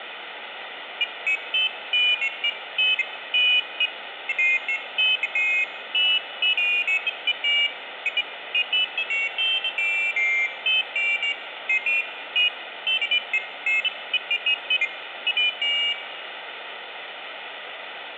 Pairs of high tones at irregular times, with phone line noise. There is no code.